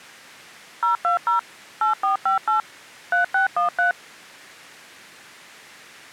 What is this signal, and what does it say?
DTMF, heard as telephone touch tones, dialled by machine, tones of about 120 ms. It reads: 020 8458 3613